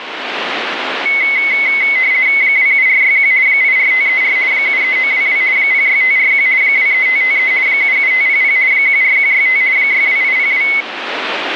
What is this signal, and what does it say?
RTTY (50 baud, 170 Hz shift), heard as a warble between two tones, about 2150 Hz centre, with radio static. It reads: 27461 84534 73922 06541 23553 77500 14165 62802